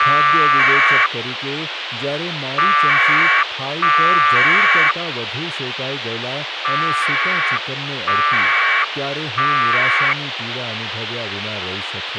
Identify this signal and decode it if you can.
Packet radio (AX.25, as in APRS), 1200 baud, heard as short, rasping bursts, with radio hiss and speech in Gujarati.